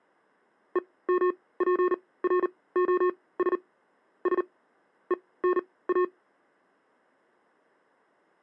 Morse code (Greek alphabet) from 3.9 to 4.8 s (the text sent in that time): Σ